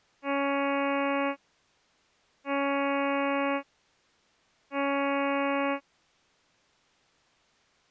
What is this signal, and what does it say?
Ship horn signal, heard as a ship's horn, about 280 Hz. 3 short. At sea: I am operating astern propulsion.